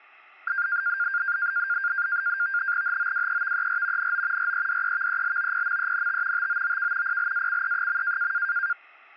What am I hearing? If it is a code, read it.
NAVTEX (SITOR-B), 100 baud, 170 Hz shift, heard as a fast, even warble, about 1500 Hz centre. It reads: HOWEVER NO REDEVELOPMENT TOOK PLACE.